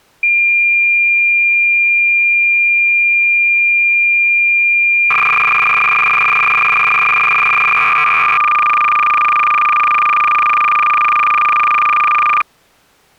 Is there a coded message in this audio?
Yes: cassette data (Kansas City type), 300 baud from 0.2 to 12.4 s, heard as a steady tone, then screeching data.